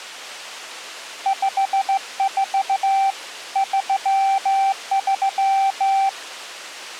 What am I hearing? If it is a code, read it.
Morse code, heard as a keyed tone, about 15 wpm, 780 Hz. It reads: 54 33